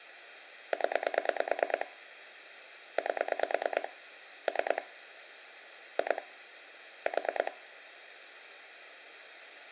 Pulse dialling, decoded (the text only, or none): 0 8 3 2 4